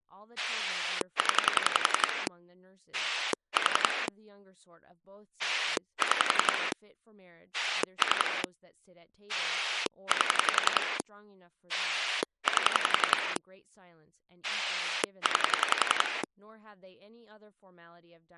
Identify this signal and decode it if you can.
Pulse dialling, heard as a rotary dial, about 11 pulses a second, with speech in English. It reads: 0 4 6 3 8 8 9